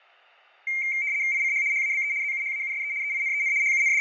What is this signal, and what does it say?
RTTY (75 baud, 170 Hz shift), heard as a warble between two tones, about 2200 Hz centre, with fading and room echo. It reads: ICH HABE ZUHAUSE EINEN …